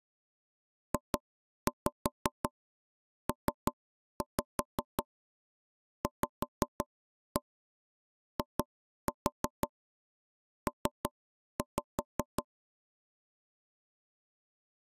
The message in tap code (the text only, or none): JPVIP